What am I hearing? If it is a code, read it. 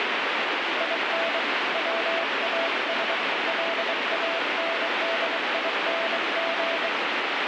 Morse code, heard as a keyed tone, hand-sent with a bug key, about 23 wpm, 660 Hz, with heavy radio static. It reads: IN WAS LANDING